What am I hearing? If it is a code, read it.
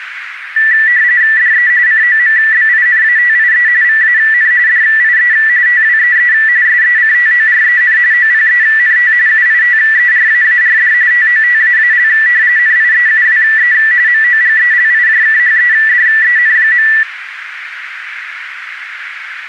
RTTY (45.45 baud, 170 Hz shift), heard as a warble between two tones, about 1850 Hz centre, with radio static and a narrow filter. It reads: DE COMBINATIE VAN DIE TWEE SECTOREN OPENT UITERAARD TOTAAL NIEUWE MOGELIJKHEDEN.